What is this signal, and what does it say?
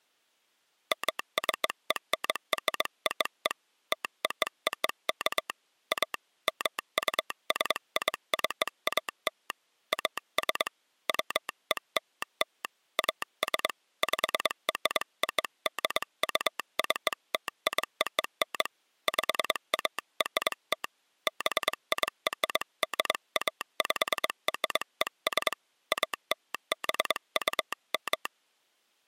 Morse code (American railroad code), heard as a telegraph sounder, hand-sent with a straight key. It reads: MCENROE TOOK A MUSICAL AS WELL AS PRODUCTION PART BIRDAPRES ALBUM